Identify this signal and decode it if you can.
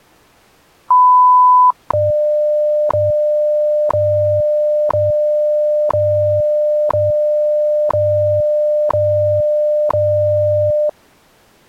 Radio time signal (WWV, Colorado), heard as ticks, one a second.